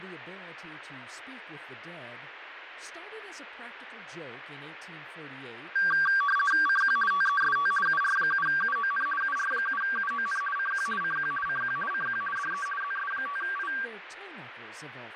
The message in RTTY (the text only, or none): CQ TEST UR7UON UR7UON CQ CQ CQ CQ DE ZS5I